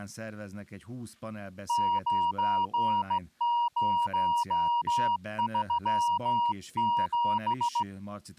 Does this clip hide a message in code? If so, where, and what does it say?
Yes: Morse code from 1.6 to 7.9 s, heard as a keyed tone, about 16 wpm, 950 Hz, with speech in Hungarian. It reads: 9037